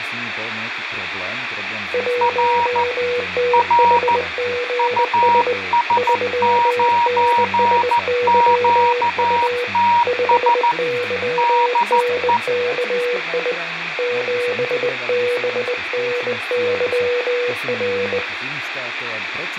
Morse code, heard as two keyed tones, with radio static and speech in Slovak. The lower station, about 20 wpm, 490 Hz: 1THGS 3NSYU 5YNKI 7BNYR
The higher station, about 14 wpm, 950 Hz: R R US9QTS DE